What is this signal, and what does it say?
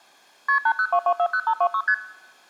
Multi-frequency trunk signalling (R1, as on North American trunks), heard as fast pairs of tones, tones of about 70 ms. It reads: KP 802240526 ST